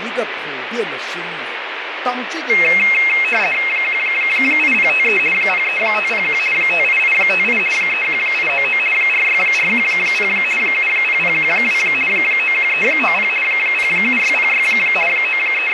RTTY (50 baud, 450 Hz shift), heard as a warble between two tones, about 2350 Hz centre, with radio static. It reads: 18053 03501 58858 31899 46410 70012 91390 07606 …